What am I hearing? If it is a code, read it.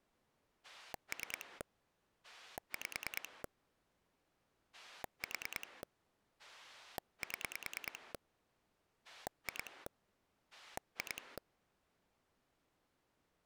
Pulse dialling, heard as a rotary dial, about 9 pulses a second. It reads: 3 5 4 7 2 2